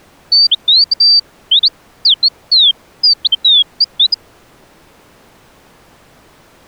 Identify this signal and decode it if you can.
Bird-like chirps. There is no code.